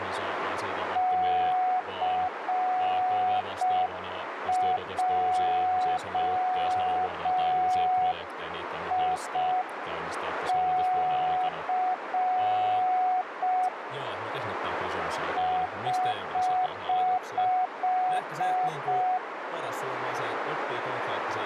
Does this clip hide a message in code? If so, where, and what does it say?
Yes: Morse code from 0.9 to 19.2 s, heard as a keyed tone, hand-sent with a straight key, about 5 wpm, 740 Hz, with radio static, a narrow filter and speech in Finnish. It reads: CJIC <HH>